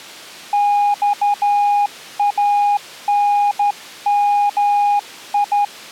Morse code (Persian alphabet), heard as a keyed tone, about 12 wpm, 820 Hz. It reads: خانمی